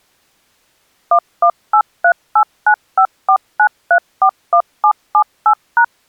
DTMF, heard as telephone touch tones, dialled by machine, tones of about 80 ms. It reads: 118389549341778#